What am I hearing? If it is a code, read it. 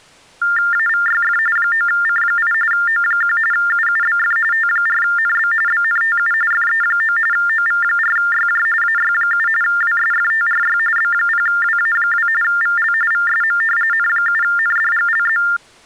TTY/TDD text telephone tones (45.45 baud Baudot), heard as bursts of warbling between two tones, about 400 Hz shift, 1600 Hz centre. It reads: AVYF 9C8 O1 UUBF T4NB BNTU FE9 OV4YJ AY7 WSFTRY B0WA2 VL VSM N7NDGLZ